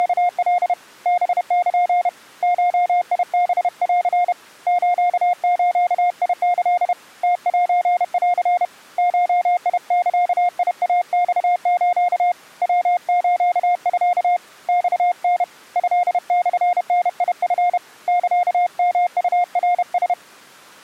Morse code (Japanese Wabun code), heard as a keyed tone, hand-sent with a paddle, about 31 wpm, 710 Hz. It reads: … ハル ゴハン スズキ ムセン ゴザイマス ヤスミ マタ トモダチ サヨウナラ